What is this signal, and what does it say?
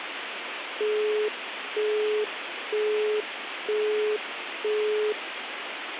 Telephone call progress tone (single-tone plan, as in Europe, Japan and elsewhere), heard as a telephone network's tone, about 420 Hz, 0.48 s on and 0.48 s off, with phone line noise. Busy tone.